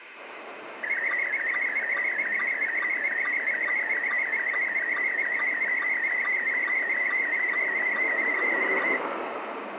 SSTV (slow-scan television), Scottie S1, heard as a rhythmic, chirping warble, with radio static and street noise.